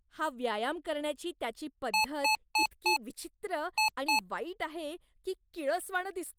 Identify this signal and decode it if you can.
Beep code, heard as beeps from a small speaker, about 860 Hz, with speech in Marathi. 4-2.